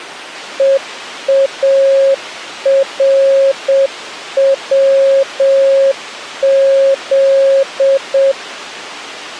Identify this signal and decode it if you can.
Morse code, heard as a keyed tone, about 7 wpm, 540 Hz. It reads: EARWZ